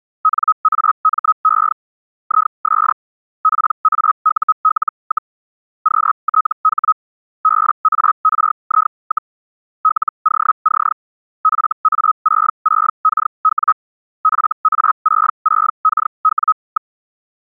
Hellschreiber (Feld-Hell, 122.5 baud), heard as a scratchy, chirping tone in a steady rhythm, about 1270 Hz. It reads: NAME IS PAUL, QTH BARI, LOC FA66KW FA66KW.